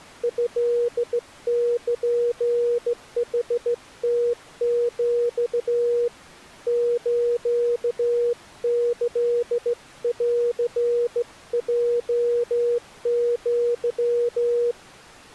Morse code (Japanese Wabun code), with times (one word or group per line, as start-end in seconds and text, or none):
0.2-6.1 トルヌムヒ
6.7-14.7 スキンヲア